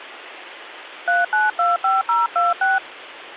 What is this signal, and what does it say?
DTMF, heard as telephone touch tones, dialled by hand, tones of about 170 ms, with phone line noise. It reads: 3925026